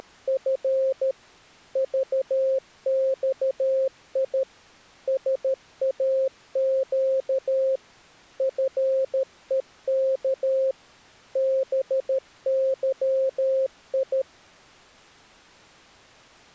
Morse code, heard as a keyed tone, machine-sent, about 13 wpm, 530 Hz. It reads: … VXI SAQ FEK BYI